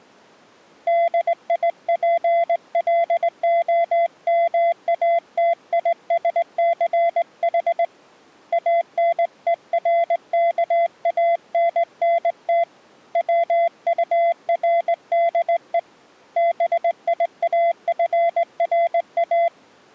Morse code, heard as a keyed tone, hand-sent with a straight key, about 19 wpm, 680 Hz. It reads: DIPLOMATISCH ANERKANNT WURDE BIAFRA